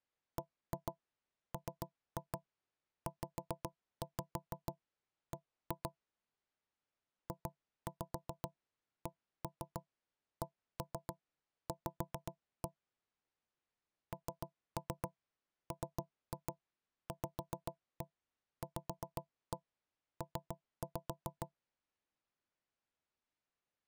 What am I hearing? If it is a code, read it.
Tap code, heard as knocks on wood, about 7 knocks a second. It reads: BMZB JCCV NMVVP